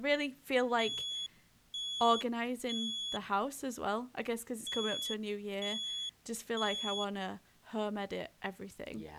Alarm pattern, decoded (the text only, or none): temporal three